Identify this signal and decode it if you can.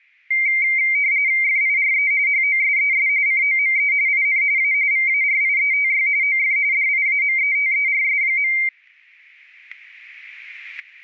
RTTY (45.45 baud, 170 Hz shift), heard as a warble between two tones, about 2200 Hz centre, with static crashes. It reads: FIRE HOSES COME IN A VARIETY OF DIAMETERS.